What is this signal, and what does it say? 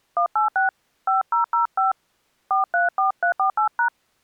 DTMF, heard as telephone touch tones, dialled by hand, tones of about 120 ms. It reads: 186 5005 434348#